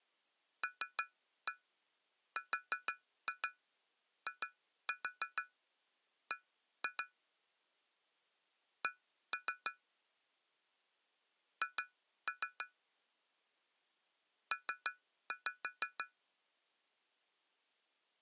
Tap code, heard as taps on glass, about 6 knocks a second. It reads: LRIB C H P